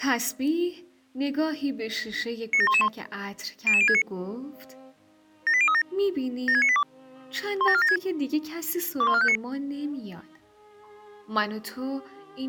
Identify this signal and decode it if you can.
Five-tone selective call (ZVEI), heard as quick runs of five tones, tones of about 70 ms. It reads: 97111 00069 78037 76982 17476 21459